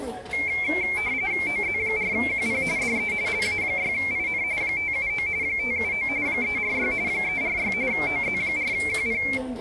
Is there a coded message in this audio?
Yes: RTTY (45.45 baud, 170 Hz shift) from 0.3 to 9.4 s, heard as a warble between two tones, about 2250 Hz centre, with the noise of a crowd indoors. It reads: OZ4QP DE LA6IN 579 579 346 346 OZ4QP